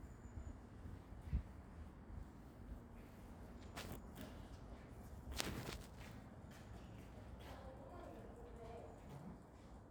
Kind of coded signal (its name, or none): none